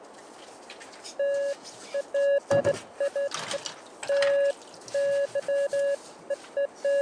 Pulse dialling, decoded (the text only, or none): none